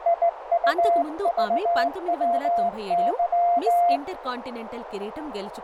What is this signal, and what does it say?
Morse code, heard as a keyed tone, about 17 wpm, 690 Hz, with radio static, a narrow filter and speech in Telugu. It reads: IUVWY